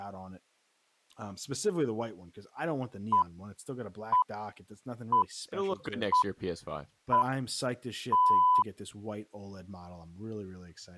Radio time signal (six pips, as the Greenwich Time Signal), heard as pips, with speech in English.